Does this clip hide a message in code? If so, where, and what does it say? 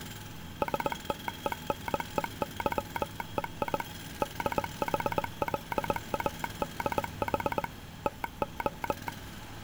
Yes: Morse code (Greek alphabet) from 0.6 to 9.1 s, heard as a telegraph sounder, machine-sent, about 20 wpm, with street noise. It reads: ΣΤΕΝΕΥΕΙ ΔΗΛΑΔΗ ΤΟ